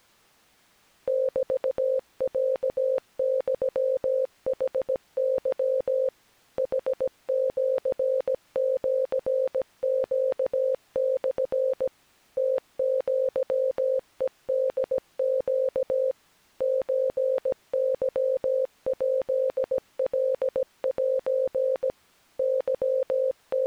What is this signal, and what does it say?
Morse code (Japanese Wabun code), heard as a keyed tone, machine-sent, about 17 wpm, 520 Hz. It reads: メロユヌケ ヌシシネモ ムアヘホネ ソケヱカセ …